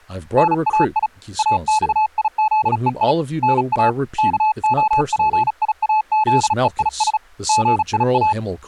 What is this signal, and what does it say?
Morse code (Greek alphabet), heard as a keyed tone, hand-sent with a bug key, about 36 wpm, 860 Hz, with speech in English. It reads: ΝΑΙ ΑΞΙΖΕΙ ΝΑ ΚΟΠΙΑΖΕΙΣ ΓΙΑ